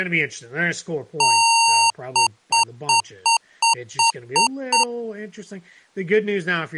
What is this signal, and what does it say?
Beep code, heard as beeps from a small speaker, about 920 Hz, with speech in English. 1 long, 8 short. In AMI BIOS tables: display or retrace test failure.